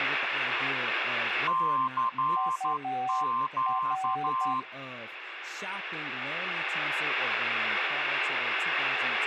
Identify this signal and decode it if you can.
Morse code, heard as two keyed tones, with radio static and speech in English. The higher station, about 12 wpm, 1050 Hz: CQ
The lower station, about 10 wpm, 760 Hz: UR